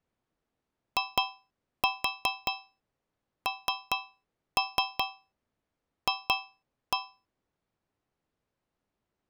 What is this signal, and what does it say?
Tap code, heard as taps on a metal pipe, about 4 knocks a second. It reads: INF